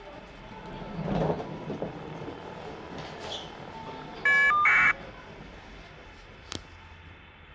Caller ID data burst, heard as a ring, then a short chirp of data, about 1200 baud, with the noise inside a lift.